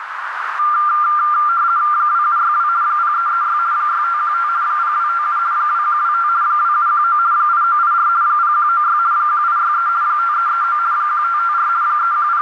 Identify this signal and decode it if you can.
RTTY (50 baud, 170 Hz shift), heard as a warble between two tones, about 1280 Hz centre, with radio static and a narrow filter. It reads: 2762 0336 6515 0257 2125 2719 8984 0196 1863 5339 1554 …